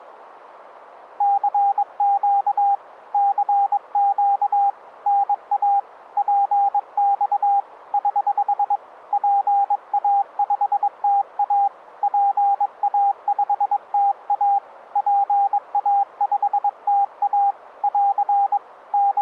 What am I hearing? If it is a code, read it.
Morse code, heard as a keyed tone, hand-sent with a paddle, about 22 wpm, 800 Hz. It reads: CQ CQ NA PX <HH> PA5TA PA5TA PA5TA <AR> …